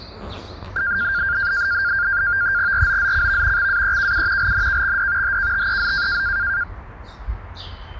NAVTEX (SITOR-B), 100 baud, 170 Hz shift, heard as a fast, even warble, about 1500 Hz centre, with the noise of a park. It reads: ROZCV XAEKU LNKXD HKTEZ